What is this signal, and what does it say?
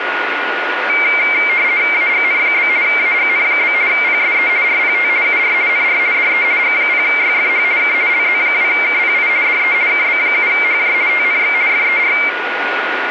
RTTY (50 baud, 170 Hz shift), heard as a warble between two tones, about 2200 Hz centre, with radio static and a steady whistle near 1450 Hz. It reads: AGN? AGN? PSE RPT UR NR DE G0YFH K LZ2KPI DE KB7HJ TNX FER